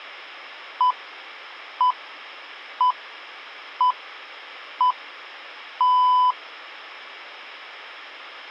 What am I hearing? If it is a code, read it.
Radio time signal (six pips, as the Greenwich Time Signal), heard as pips.